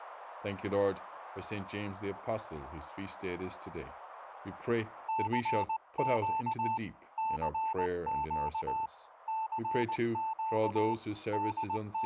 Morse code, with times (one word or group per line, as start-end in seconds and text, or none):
5.1-6.8 CQ
7.2-8.9 CQ
9.3-10.9 CQ
11.3-12.1 …